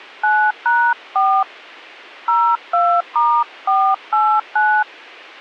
DTMF, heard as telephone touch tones, dialled by hand, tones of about 270 ms, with a squelch burst at the end. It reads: 9#4 02*489